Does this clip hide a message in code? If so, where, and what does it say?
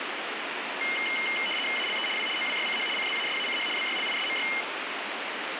Yes: RTTY (75 baud, 850 Hz shift) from 0.8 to 4.6 s, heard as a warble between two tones, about 2550 Hz centre, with radio static. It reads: ALE W OWYCH CZASACH BYLISMY